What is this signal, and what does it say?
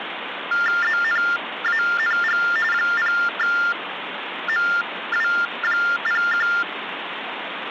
TTY/TDD text telephone tones (45.45 baud Baudot), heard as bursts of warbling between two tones, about 400 Hz shift, 1600 Hz centre, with phone line noise. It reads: ZNANG 0MW01